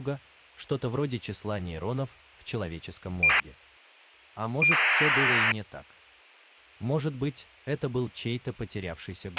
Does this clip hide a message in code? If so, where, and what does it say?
Yes: ACARS aircraft data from 3.2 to 5.5 s, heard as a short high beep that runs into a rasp, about 2400 baud, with a squelch burst at the end.